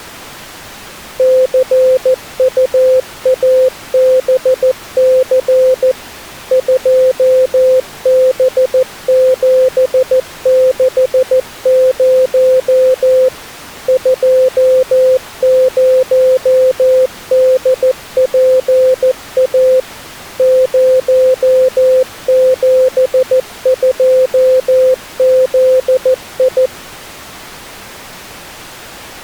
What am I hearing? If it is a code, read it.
Morse code, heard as a keyed tone, machine-sent, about 14 wpm, 520 Hz. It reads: CUABC 2B760 20DPA 072ZI